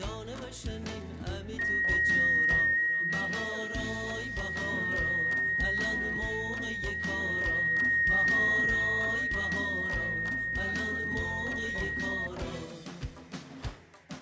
FT8 (one signal), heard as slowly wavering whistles, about 6.25 baud, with fading and static crashes.